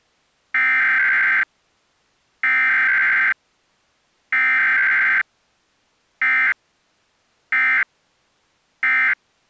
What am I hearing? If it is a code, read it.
Emergency Alert System (SAME) tones (header bursts, then end-of-message bursts), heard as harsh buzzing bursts, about 520.83 baud.